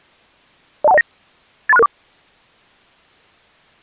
Five-tone selective call (EIA), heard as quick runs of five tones, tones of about 30 ms. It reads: 02109 83664